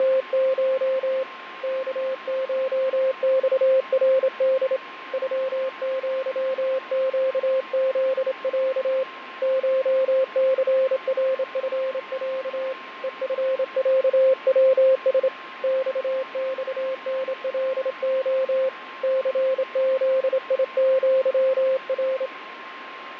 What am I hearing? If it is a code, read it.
Morse code (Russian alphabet), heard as a keyed tone, hand-sent with a straight key, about 27 wpm, 530 Hz, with radio static, fading and a steady whistle near 1060 Hz. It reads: … КШЬРД ЮЪЩЗЯ ШЦРФЯ ЕФЯВС ЬЬНЛО ЦЗИЪР